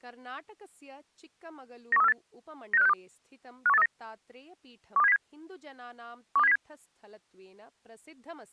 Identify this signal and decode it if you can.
Five-tone selective call (EEA), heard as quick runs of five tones, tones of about 40 ms, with speech in Sanskrit. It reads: 91348 96562 51839 12707 12707